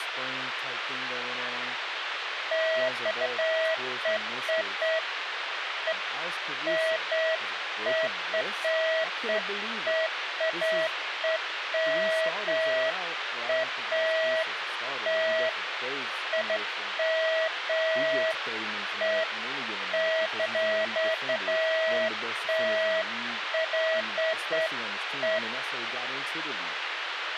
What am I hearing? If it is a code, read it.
Beeps of irregular length, with radio hiss, a squelch burst at the end and speech in English. There is no code.